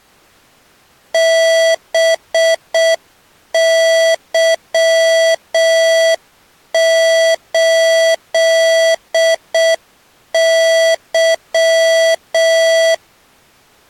Morse code, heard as electronic beeps, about 6 wpm, 660 Hz. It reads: BY8Y